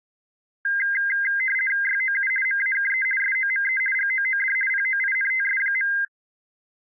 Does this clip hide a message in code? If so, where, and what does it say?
Yes: RTTY (50 baud, 450 Hz shift) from 0.6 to 6.0 s, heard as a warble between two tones, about 1850 Hz centre. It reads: YOU MAKE SOME GOOD POINTS.